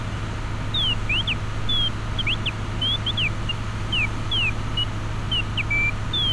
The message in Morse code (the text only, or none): none